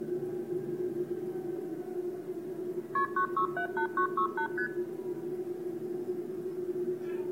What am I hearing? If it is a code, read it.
Multi-frequency trunk signalling (R1, as on North American trunks), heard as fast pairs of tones, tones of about 90 ms, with the noise inside a subway train. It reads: KP 9678968 ST